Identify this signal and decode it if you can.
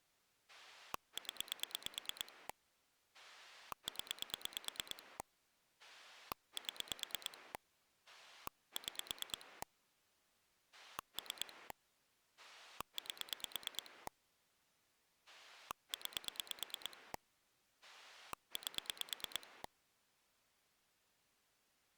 Pulse dialling, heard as a rotary dial, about 9 pulses a second. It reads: 0 0 7 6 3 8 9 8